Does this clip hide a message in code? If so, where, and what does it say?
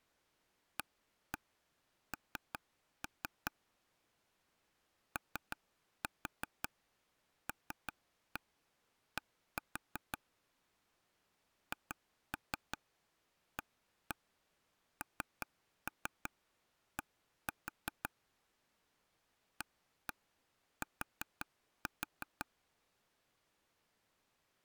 Yes: tap code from 0.8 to 22.4 s, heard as taps on a table, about 5 knocks a second. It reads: AN OLD HAND AT